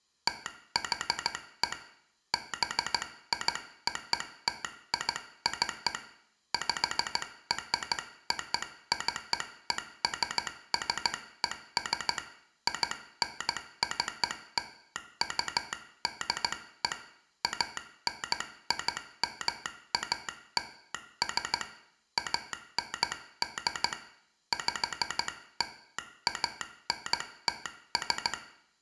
Morse code (American railroad code), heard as a telegraph sounder, hand-sent with a straight key, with room echo. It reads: THE BIOTIC PROCESSES INCLUDE ANIMALS AND PLANTS